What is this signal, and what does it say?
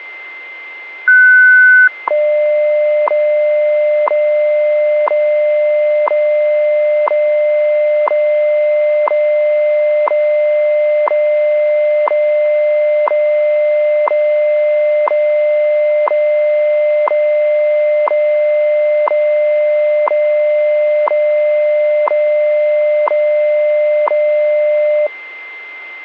Radio time signal (WWV, Colorado), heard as ticks, one a second, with a steady whistle near 2080 Hz.